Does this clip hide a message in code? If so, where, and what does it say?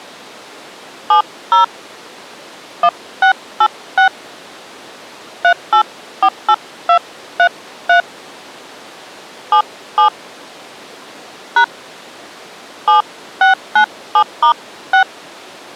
Yes: DTMF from 1.1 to 15.0 s, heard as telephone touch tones, dialled by hand, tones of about 100 ms. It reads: 70 1686 3848233 77 # 7697*6